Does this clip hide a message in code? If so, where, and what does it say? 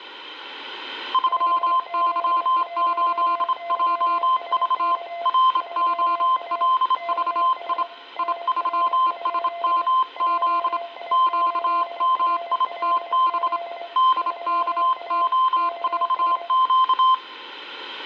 Yes: Morse code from 1.1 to 17.2 s, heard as two keyed tones, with room echo. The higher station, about 27 wpm, 1040 Hz: 3Y8JV ROLVI I3SMZ QMITB DKO4Q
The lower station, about 24 wpm, 680 Hz: 5Z1YSK 3A KS NR? JI8RLZ 3A KS